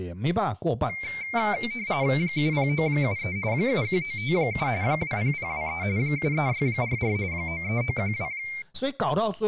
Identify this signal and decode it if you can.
RTTY (45.45 baud, 170 Hz shift), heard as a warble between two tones, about 2200 Hz centre, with speech in Chinese. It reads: 70973 71957 20023 73644 93912